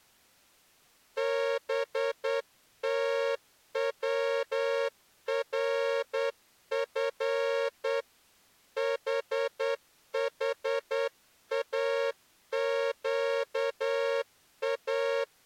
Morse code (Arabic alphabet), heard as a horn, hand-sent with a straight key, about 9 wpm. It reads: بتورف ححاقا